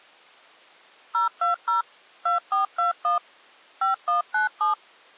DTMF, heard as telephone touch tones, dialled by machine, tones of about 130 ms. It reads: 020 2421 5197